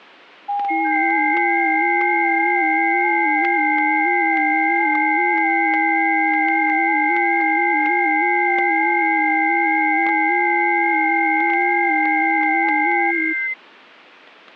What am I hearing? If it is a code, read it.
FT8 (several signals at once), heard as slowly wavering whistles, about 6.25 baud, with static crashes.